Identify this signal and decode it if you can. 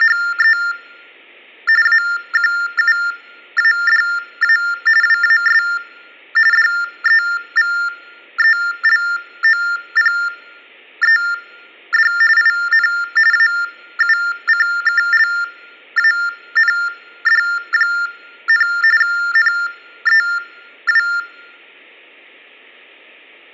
TTY/TDD text telephone tones (45.45 baud Baudot), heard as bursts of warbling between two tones, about 400 Hz shift, 1600 Hz centre. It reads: … AQUADA WAS DEVELOPED IN AUCKLAND, NEW